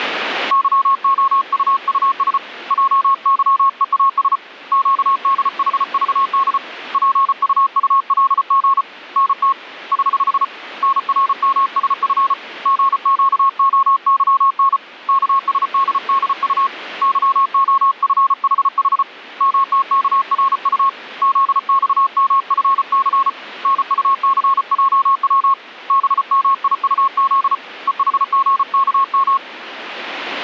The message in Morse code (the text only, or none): YOUUS JYEAS QDHVD PUULG NT <HH> NRMSF GQOYN KSDDU YOFHH MTKRU ZXMFC NUCJW BMIUZ EHGKM